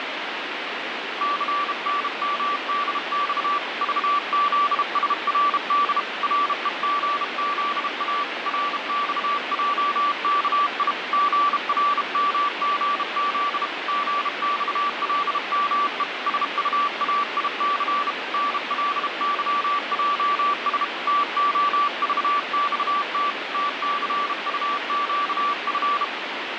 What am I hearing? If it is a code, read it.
Morse code, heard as a keyed tone, hand-sent with a bug key, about 32 wpm, 1160 Hz, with radio static. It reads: CNMDX VZSRD REGZA RXJKI GRMGZ GXLME SUAIC NLYJS TOVXT TCUQF